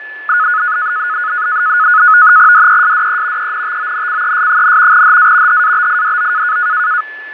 NAVTEX (SITOR-B), 100 baud, 170 Hz shift, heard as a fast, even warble, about 1360 Hz centre, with fading and a steady whistle near 1730 Hz. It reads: DESDE ENTONCES, HA HABIDO